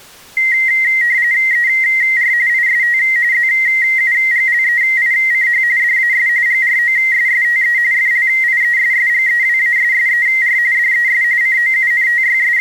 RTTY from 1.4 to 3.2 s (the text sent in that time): ER IST